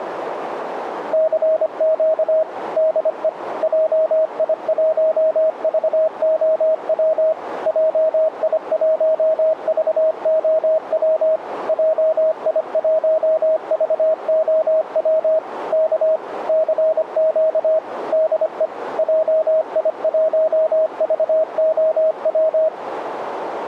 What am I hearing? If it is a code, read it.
Morse code, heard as a keyed tone, machine-sent, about 25 wpm, 630 Hz, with radio static. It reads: CQ DE JI1VOW JI1VOW JI1VOW K CQ DE JI1VOW